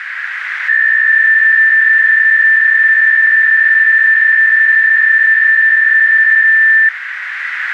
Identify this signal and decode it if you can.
PSK63 (62.5 baud), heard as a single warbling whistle, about 1800 Hz, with radio static and a narrow filter.